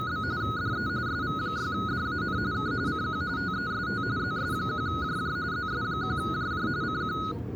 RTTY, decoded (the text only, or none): … DE SV6DAN K CQ TEST ZS1JJ ZS1JJ CQ